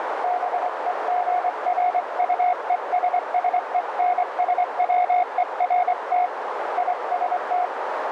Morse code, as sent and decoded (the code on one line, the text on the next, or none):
-... . --. .-. ..- . ... ... . -. ... .-- . .-. - / .. ... -
BEGRUESSENSWERT IST